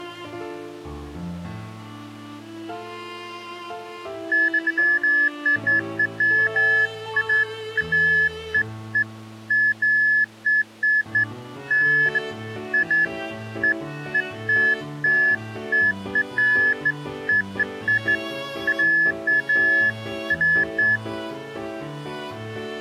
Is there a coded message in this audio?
No, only beeps of irregular length.